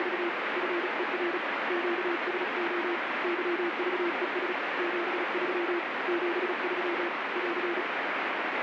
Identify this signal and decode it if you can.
Morse code, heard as a keyed tone, hand-sent with a paddle, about 36 wpm, 340 Hz, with heavy radio static. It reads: … FER QSO YVES 73 73 <AR>